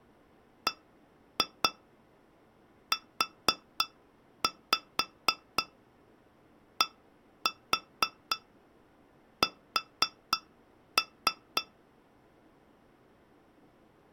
Tap code, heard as taps on glass, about 4 knocks a second. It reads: BUDS